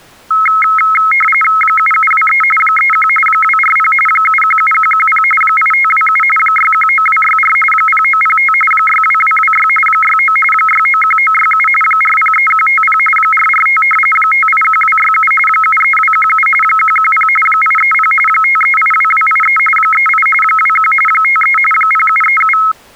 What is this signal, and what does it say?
RTTY (45.45 baud, 850 Hz shift), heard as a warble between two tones, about 1700 Hz centre. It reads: 7723 31 240 717110 8527 619264 0905 62226 69 691967 403150 445 581267 73217 110 830 5382283 38 21 53 0737